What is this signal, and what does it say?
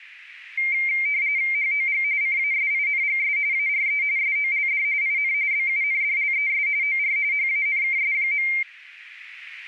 RTTY (45.45 baud, 170 Hz shift), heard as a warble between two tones, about 2200 Hz centre. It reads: HOG CASINGS ARE SOLD IN BUNDLES OR HANKS.